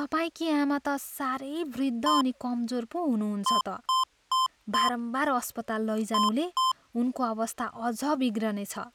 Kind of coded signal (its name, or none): beep code